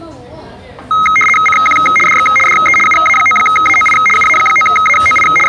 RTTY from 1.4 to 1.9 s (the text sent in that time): CQ